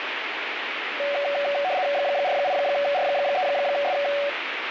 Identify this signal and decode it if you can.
RTTY (75 baud, 170 Hz shift), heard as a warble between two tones, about 660 Hz centre, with radio static. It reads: 48R3S